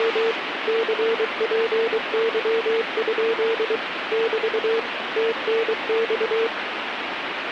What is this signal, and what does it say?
Morse code, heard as a keyed tone, machine-sent, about 23 wpm, 460 Hz, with radio static. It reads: … CPY? <BT> TNX